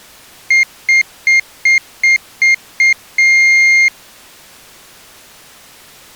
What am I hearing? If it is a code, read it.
Beep code, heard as a piezo beeper, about 2100 Hz. 7 short, 1 long.